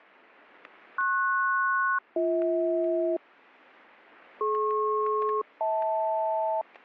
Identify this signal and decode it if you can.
Aircraft SELCAL, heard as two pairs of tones, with static crashes. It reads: PS-BH DP-HL